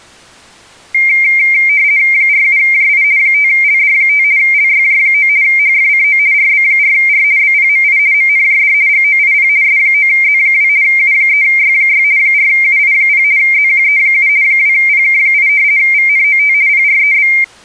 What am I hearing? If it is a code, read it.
RTTY (50 baud, 170 Hz shift), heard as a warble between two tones, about 2200 Hz centre. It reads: 47JI 5LD5 LYJ9 HFCO RB4R BPMI MNJD GOIP S9Z2 U3Y6 4UI0 ZQE7 2PK8 VNOT PREB